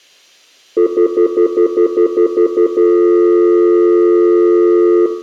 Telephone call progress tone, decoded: stutter dial tone

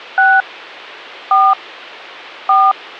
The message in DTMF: 6 4 4

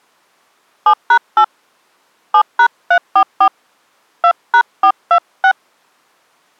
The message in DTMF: 7#8 7#344 2#426

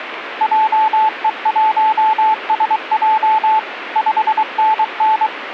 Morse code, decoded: JE1SJ 5NN

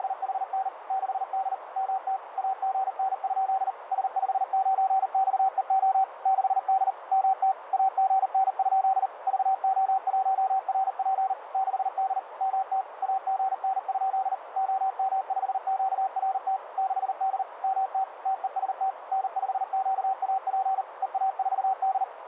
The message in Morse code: … 6D MT AGN? S59XEO 6D MT AGN? VO1RP 6D MT AGN? OM5QRT 6D MT TEST N5QAP EA4D

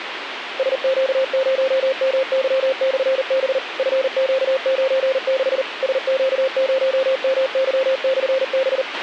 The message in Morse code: SQ0MY/B FQ96 SQ0MY/B

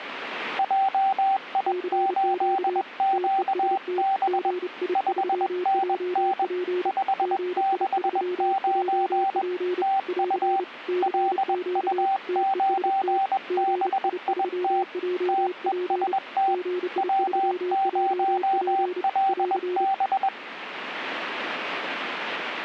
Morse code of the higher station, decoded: JI8QB 5NN 569 TU LU9BIT TEST W0LB

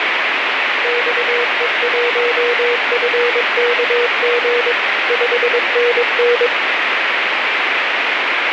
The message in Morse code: XE1FKG 5NN

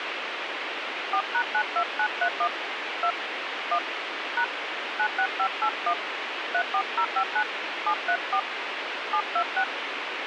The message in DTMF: 4#92931 2 1 # 96581 34059 734 726

